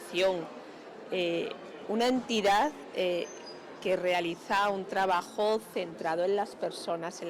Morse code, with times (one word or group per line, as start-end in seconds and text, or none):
none